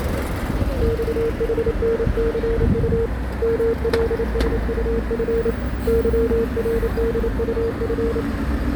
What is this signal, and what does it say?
Morse code, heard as a keyed tone, hand-sent with a paddle, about 28 wpm, 460 Hz, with radio static and street noise. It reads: XHNCU MLSUF YRDUF